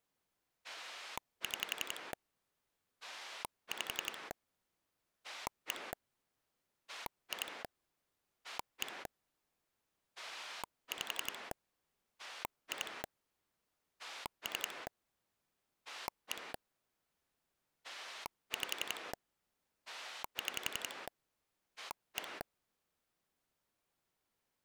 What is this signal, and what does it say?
Pulse dialling, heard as a rotary dial, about 11 pulses a second. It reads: 6 5 1 2 1 5 2 3 1 5 6 1